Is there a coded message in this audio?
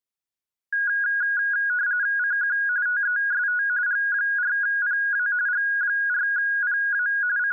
Yes: RTTY (45.45 baud, 170 Hz shift) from 0.7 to 7.5 s, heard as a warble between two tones, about 1550 Hz centre. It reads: CQ TEST G4PA G4PA …